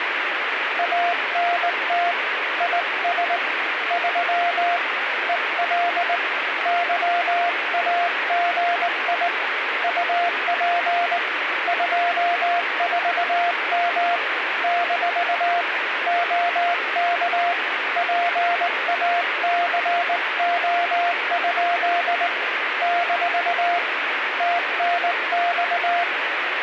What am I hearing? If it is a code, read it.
Morse code, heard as a keyed tone, hand-sent with a straight key, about 19 wpm, 700 Hz, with radio static. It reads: ANT IS 3 EL YAGI UP 24M - OK PACO? - TNX